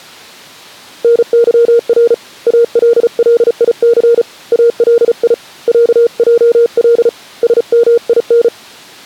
Morse code (Arabic alphabet), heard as a keyed tone, hand-sent with a paddle, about 35 wpm, 470 Hz. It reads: نظر الليث الي عجل سمين